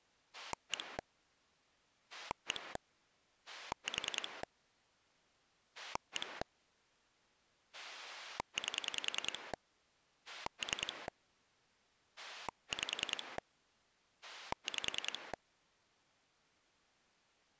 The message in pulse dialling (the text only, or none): 1 1 4 1 8 3 5 5